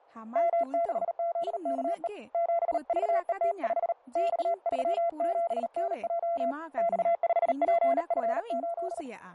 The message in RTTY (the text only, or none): none